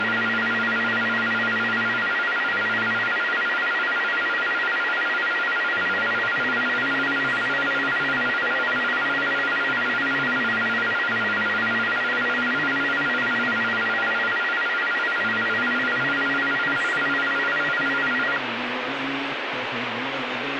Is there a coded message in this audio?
No, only a tone that alternates evenly between two pitches, with radio static.